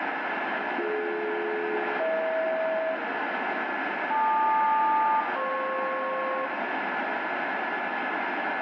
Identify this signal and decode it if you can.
Aircraft SELCAL, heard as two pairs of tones, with radio static and room echo. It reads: BD-EH LQ-FP